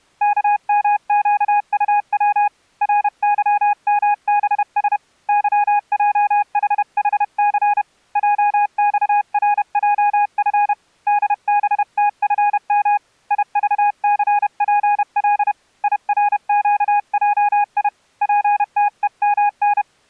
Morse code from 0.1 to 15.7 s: KMQUW RYMBS YJHHC JXRJF DBTFM IVCPL

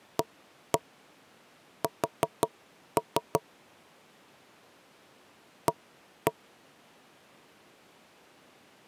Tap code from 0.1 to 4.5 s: AS

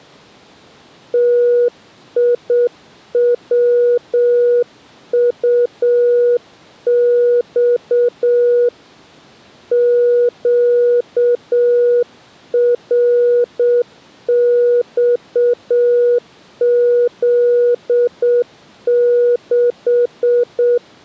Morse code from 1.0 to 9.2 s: TIWUX

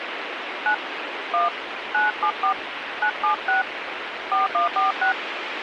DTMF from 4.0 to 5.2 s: 4146

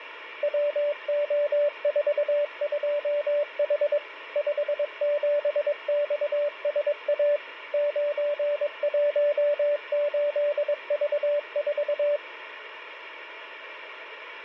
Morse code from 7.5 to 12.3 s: 918V4

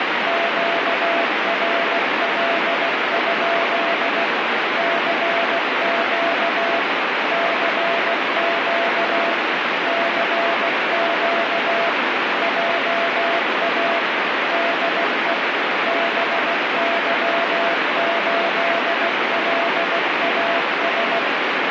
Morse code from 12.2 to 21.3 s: JA DE BY8LAS

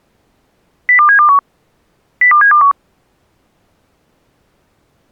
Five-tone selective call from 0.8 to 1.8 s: 02721

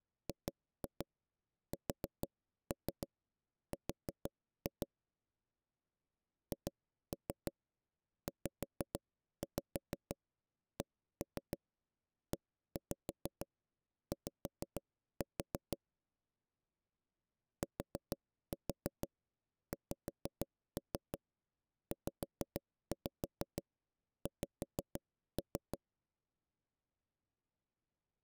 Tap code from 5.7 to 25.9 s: HZCEY TXZX

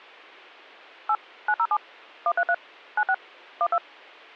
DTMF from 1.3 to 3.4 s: 907 133 96

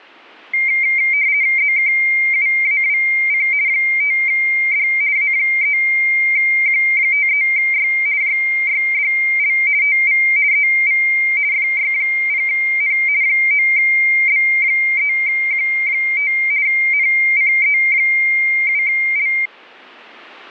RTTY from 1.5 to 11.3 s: ZKUAWC 5D A3Q53Y JYDL TV EV

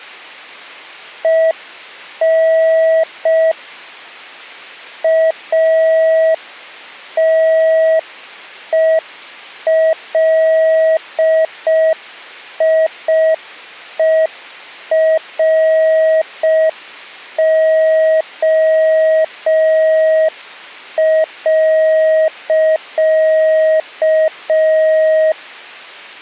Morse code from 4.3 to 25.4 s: ATELIERO.

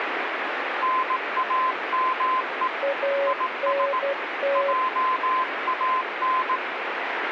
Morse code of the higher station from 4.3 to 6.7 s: JAN

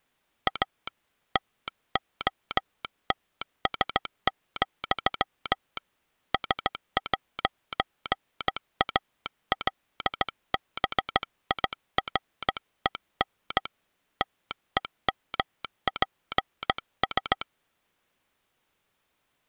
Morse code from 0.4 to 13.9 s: A TOTS, S'ALBIREN

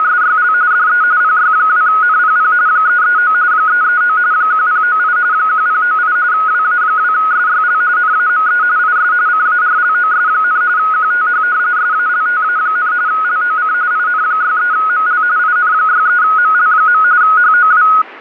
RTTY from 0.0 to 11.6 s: … DE PY2NPP 339 339 1098 1098 WA2SYL NAME IS CARLOS, QTH

